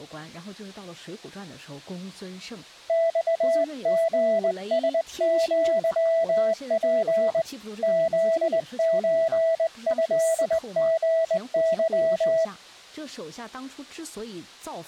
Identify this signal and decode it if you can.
Morse code (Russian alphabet), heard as a keyed tone, hand-sent with a straight key, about 20 wpm, 660 Hz. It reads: ЬГСЪП ЗЧЭГЫ